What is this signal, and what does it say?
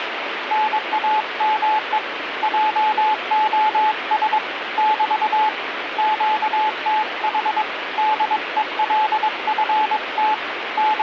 Morse code, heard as a keyed tone, hand-sent with a paddle, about 22 wpm, 860 Hz, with radio static. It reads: NAME JOS <BT> QTH DELFT …